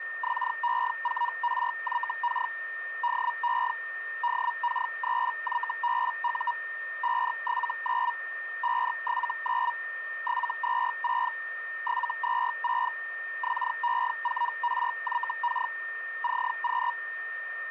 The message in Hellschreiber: XE4RYK DE DK3YBU 579 579 726 726 XE4RYK CQ

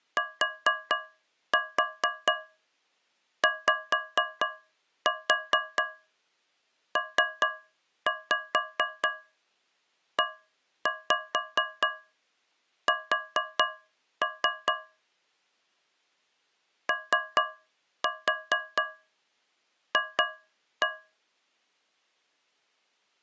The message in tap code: TYPES OF

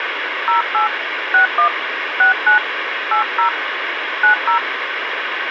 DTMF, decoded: 08 61 69 80 90

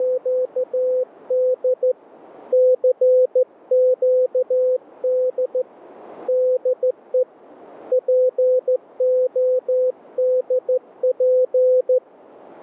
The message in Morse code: … CQD DE PODP

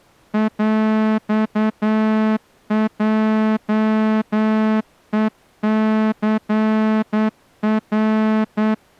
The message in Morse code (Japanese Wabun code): ヰヲヘニナ

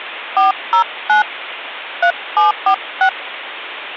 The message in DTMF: 409 3746

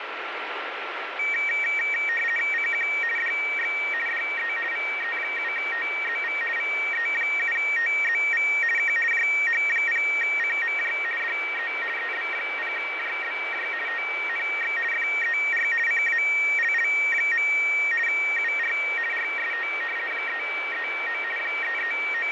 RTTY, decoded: CQ DX DE VE7TZV VE7TZV K JH0CMJ DE EB0JBJ TNX FER CALL. UR RST 339 …

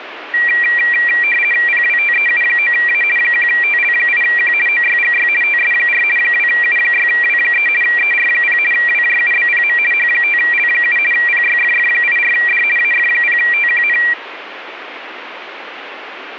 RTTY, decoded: PWTEU9A 1TL8Q OYGY TS4 2U6W3 ER0 WJUBPM H5L7 PYFF84D AF0TQN

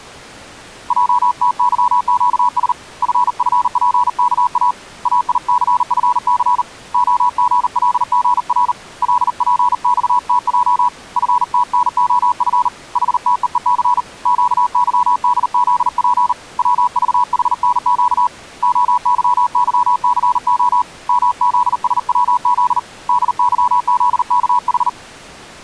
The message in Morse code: JTYQS FFPKA AICFC OGLGR LPXTJ FTNOF HTEEC QYDZP WVHNQ OYYCO MZSWZ DYZKH

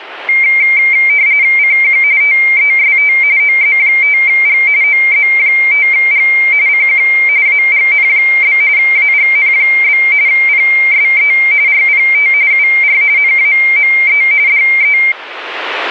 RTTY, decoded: CQ TEST OZ5G OZ5G CQ AGN? AGN? PSE RPT UR NAME DE

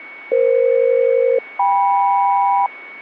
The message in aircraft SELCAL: EF-KM

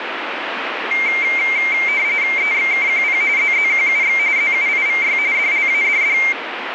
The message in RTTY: EXKQP ZZQUX ZUIVY DLADD

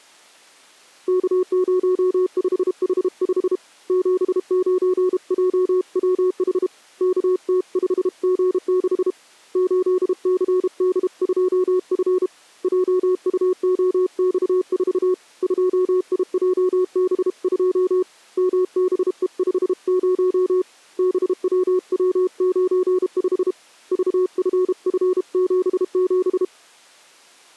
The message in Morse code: K05H5 79JWH KT5G6 8CD2F JUOX4 2IJB2 MBE50 BWW95 VFF77

